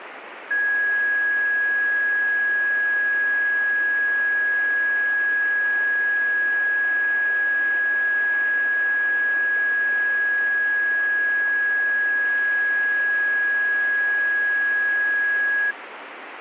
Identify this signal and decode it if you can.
A steady tone, with radio static. There is no code.